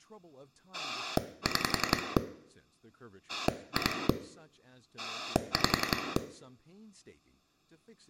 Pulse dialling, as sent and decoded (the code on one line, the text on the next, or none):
6 / 2 / 5
6 2 5